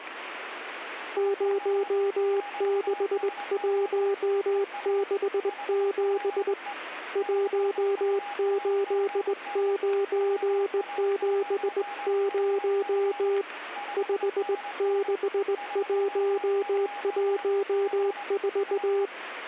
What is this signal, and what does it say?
Morse code, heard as a keyed tone, hand-sent with a straight key, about 19 wpm, 400 Hz, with a weaker station near 820 Hz. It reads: 06167 18970 56114